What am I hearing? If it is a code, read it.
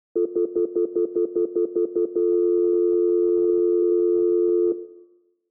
Telephone call progress tone (North American plan), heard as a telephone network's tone, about 350, 440 Hz, 0.1 s on and 0.1 s off, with room echo. Stutter dial tone.